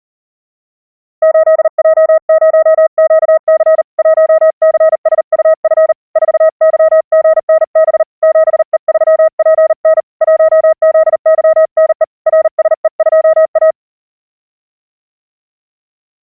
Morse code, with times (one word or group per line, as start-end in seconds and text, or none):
1.2-3.8 8J0QC
4.0-5.9 1CSUF
6.2-8.0 4YGNB
8.2-10.0 7E3PN
10.2-12.0 1ZYNE
12.3-13.7 RSE2A